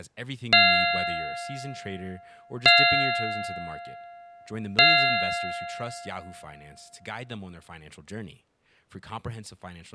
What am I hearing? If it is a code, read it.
Clock strike, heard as a bell, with speech in English. 3. Three o'clock.